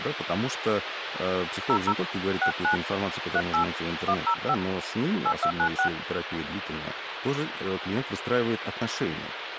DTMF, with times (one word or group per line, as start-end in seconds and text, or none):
1.7-1.9 00
2.4-2.8 69
3.4-3.6 38
4.1-4.5 105
5.3-5.9 8296